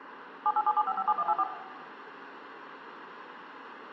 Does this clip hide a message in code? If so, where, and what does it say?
Yes: DTMF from 0.5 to 1.4 s, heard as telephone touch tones, dialled by machine, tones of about 50 ms, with phone line noise and room echo. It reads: 7877557184